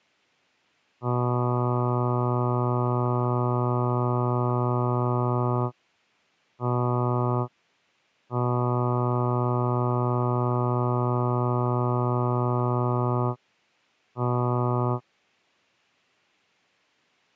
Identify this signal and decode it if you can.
Ship horn signal, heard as a ship's horn, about 120 Hz. 1 long, 1 short, 1 long, 1 short. At sea: I agree to be overtaken.